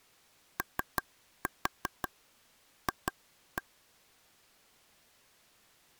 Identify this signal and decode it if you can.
Tap code, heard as taps on a table, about 5 knocks a second. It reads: OF